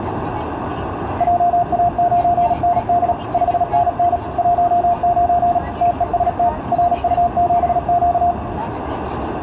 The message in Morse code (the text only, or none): JA9ND 5NN 19 TEST RU7Q